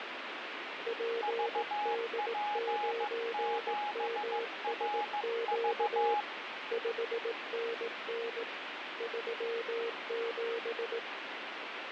Morse code, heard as two keyed tones, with radio static. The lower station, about 18 wpm, 460 Hz: PD9MSQ 5NN 37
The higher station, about 15 wpm, 830 Hz: VP7RV